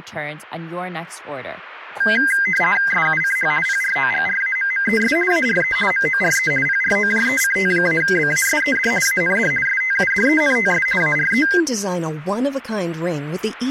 RTTY (50 baud, 450 Hz shift), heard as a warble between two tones, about 1800 Hz centre, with speech in English. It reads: SUCH PROGRAMMES ARE MORE PROJECT-BASED AND STUDENTS ARE